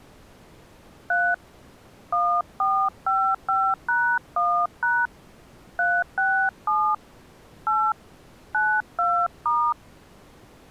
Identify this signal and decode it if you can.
DTMF, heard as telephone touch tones, dialled by hand, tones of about 270 ms. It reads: 3 1455#1# 367 8 92*